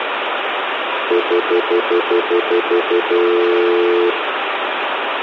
Telephone call progress tone (North American plan), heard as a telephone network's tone, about 350, 440 Hz, 0.1 s on and 0.1 s off, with phone line noise and room echo. Stutter dial tone.